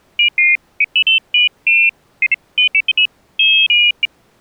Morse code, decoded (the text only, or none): none